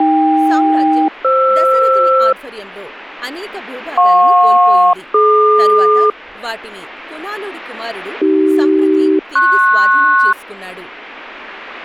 Aircraft SELCAL, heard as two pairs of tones, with speech in Telugu. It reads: AK-FR JP-DQ AC-PS